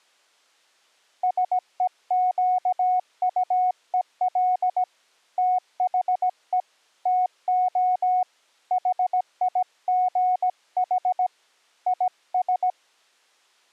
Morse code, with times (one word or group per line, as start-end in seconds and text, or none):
1.2-4.8 SEQUEL
5.4-6.6 THE
7.1-8.2 TO
8.7-11.3 HIGH
11.9-12.7 IS